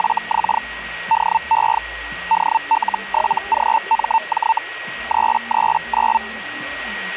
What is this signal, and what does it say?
Hellschreiber (Feld-Hell, 122.5 baud), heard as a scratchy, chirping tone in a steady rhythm, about 900 Hz, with a steady whistle near 1900 Hz and the noise of a crowd indoors. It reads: … DE DL7GMJ 339